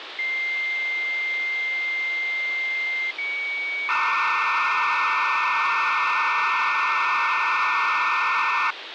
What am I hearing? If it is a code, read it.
Dial-up modem handshake (low-speed, two carriers), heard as two whistles, then hiss, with phone line noise.